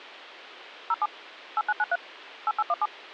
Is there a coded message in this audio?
Yes: DTMF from 0.9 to 2.9 s, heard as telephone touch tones, dialled by machine, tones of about 40 ms. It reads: 07 8993 8817